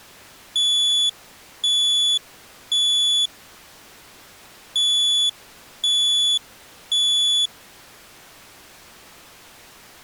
Alarm pattern, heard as an alarm's beeps, played twice, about 3450 Hz. Temporal three. Smoke or fire, evacuate.